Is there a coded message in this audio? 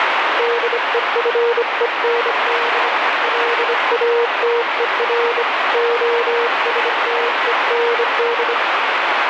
Yes: Morse code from 0.3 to 8.6 s, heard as a keyed tone, hand-sent with a bug key, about 25 wpm, 470 Hz, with heavy radio static. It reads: DEFEND LATER OSTEND